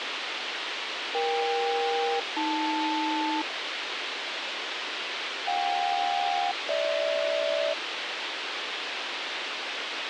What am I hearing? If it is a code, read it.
Aircraft SELCAL, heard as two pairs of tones, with radio hiss. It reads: EK-AL JK-GH